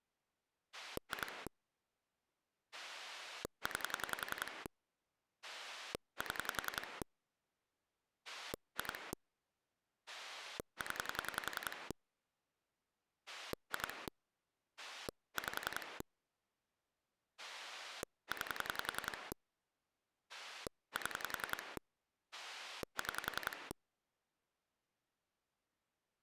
Pulse dialling, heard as a rotary dial, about 10 pulses a second. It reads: 2 9 7 2 0 2 5 9 7 6